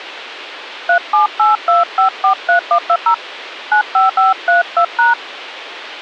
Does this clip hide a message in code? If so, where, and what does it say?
Yes: DTMF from 0.9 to 5.1 s, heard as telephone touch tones, dialled by hand, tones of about 110 ms. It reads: 3782543120 95532#